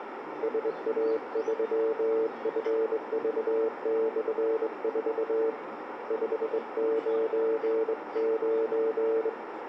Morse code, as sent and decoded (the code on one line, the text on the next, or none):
... .- ...-- ..-. ...- -..-. ....- / ..... ----. ----.
SA3FV/4 599